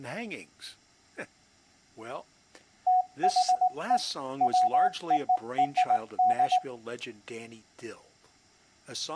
Morse code (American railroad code), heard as a keyed tone, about 740 Hz, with speech in English. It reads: THE WORD